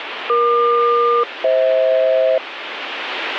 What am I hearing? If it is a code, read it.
Aircraft SELCAL, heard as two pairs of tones, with radio static. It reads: EQ-FH